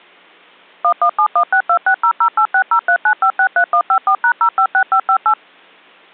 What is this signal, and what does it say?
DTMF, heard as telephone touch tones, dialled by machine, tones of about 80 ms. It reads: 11716260086039563154#056558